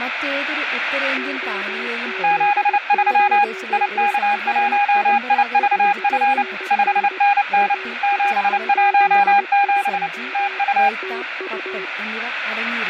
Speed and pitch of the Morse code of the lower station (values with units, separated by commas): 19 wpm, 380 Hz